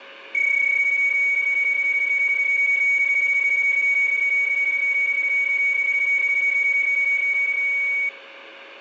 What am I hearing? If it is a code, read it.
PSK31 (31.25 baud), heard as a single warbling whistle, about 2250 Hz, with radio static, a steady whistle near 550 Hz and room echo.